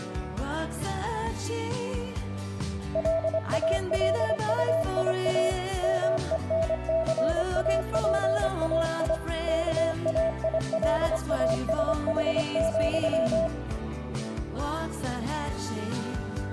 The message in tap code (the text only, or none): none